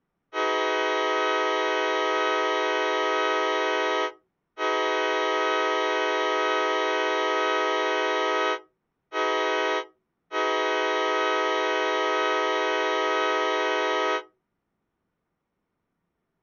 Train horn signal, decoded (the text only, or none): 2 long, 1 short, 1 long